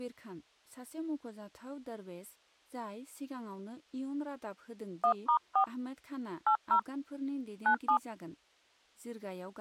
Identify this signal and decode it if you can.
DTMF, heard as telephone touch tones, dialled by hand, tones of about 90 ms, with speech in Bodo. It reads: 1*4 80 97